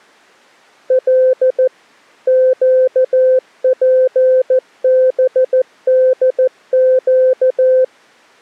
Morse code, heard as a keyed tone, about 14 wpm, 520 Hz. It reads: L QPBDQ